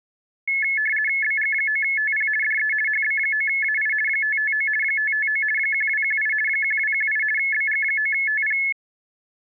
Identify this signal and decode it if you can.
RTTY (50 baud, 450 Hz shift), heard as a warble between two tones, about 1950 Hz centre. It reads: BG9TP DE HB9AI 559 559 1218 1218 BG9TP